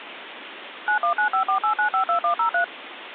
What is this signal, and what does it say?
DTMF, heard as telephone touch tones, dialled by machine, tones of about 100 ms, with phone line noise. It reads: 919548952103